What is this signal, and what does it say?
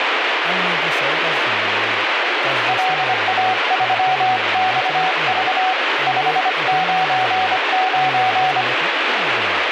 Morse code, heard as a keyed tone, hand-sent with a paddle, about 25 wpm, 750 Hz, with radio static and speech in Bodo. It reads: LA3XV 599